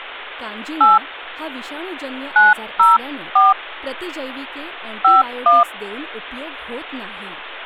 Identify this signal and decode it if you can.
DTMF, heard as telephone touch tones, dialled by hand, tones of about 170 ms, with speech in Marathi. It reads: 8 904 51